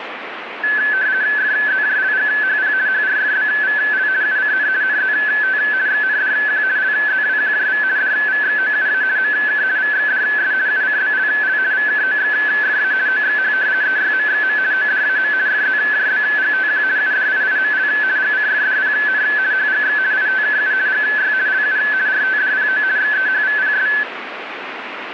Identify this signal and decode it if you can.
RTTY (50 baud, 170 Hz shift), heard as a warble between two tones, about 1600 Hz centre, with radio static. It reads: FZJLGHP HRFBVL UCN NZT XNDQ LZWQJV DVXOUA MK VXDS UCBLL VKOXFA OXH EYMXM ODAM FZJBGTQ UDIIML GCFDPN HGX ITKU GY LU RTDPO XEHVPS